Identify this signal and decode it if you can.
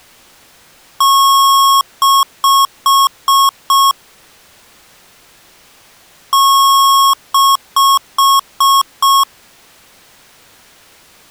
Beep code, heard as beeps from a small speaker, played twice, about 1090 Hz. 1 long, 5 short.